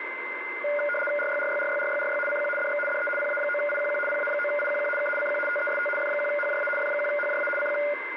RTTY (75 baud, 850 Hz shift), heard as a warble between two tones, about 1010 Hz centre, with radio static and a steady whistle near 2070 Hz. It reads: RYRYRYRYRY CQ DX DE PA9IQQ PA9IQQ K CQ TEST F1HJA F1HJA CQ